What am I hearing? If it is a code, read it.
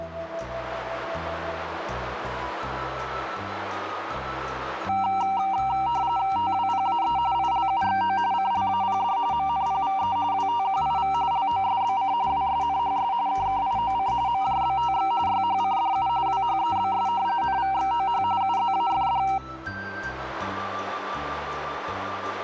RTTY (45.45 baud, 170 Hz shift), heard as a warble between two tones, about 860 Hz centre, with radio static. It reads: TWPAE ILUXO CLAPD MNPVE WTQIV LOSBC WSNHS KKIOC MJBTX YHCDU WHEBS NVXOH UZAFD